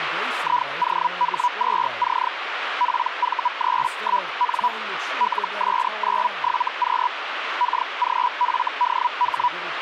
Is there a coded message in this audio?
Yes: Hellschreiber (Feld-Hell, 122.5 baud) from 0.4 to 9.5 s, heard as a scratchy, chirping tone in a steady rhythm, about 980 Hz, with radio static and speech in English. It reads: IOH2C PV31N LS97Q KGFDH